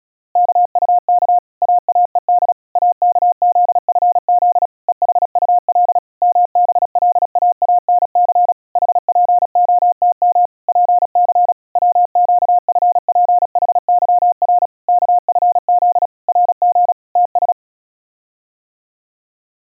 Morse code, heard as a keyed tone, machine-sent, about 36 wpm, 710 Hz. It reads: KUK AAED AKZFZ EHUL MBLAANC HPOTM PC WQFPHYR KFZ RG TS